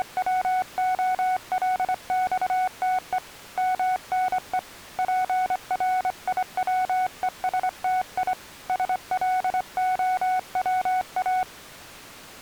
Morse code (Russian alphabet), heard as a keyed tone, hand-sent with a straight key, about 25 wpm, 740 Hz. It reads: … МНЕ ПРИВЕСТИ СЛОВА